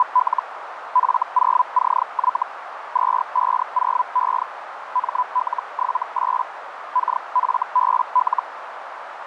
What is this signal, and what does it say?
Hellschreiber (Feld-Hell, 122.5 baud), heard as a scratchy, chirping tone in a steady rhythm, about 1000 Hz, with radio static and a narrow filter. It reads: … F0CY 250E ML78 KFBL